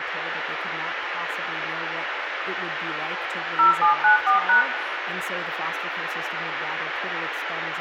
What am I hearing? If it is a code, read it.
DTMF, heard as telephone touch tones, dialled by machine, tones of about 120 ms, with radio hiss, room echo and speech in English. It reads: 0794#